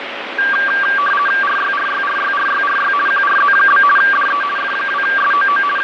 RTTY (50 baud, 450 Hz shift), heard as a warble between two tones, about 1370 Hz centre, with radio static and fading. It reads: RYRYRYRYRY QRZ? DE F2SOO …